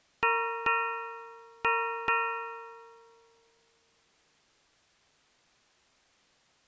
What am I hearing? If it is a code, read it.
Ship's bell, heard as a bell. 4. Four half-hours of the watch have passed.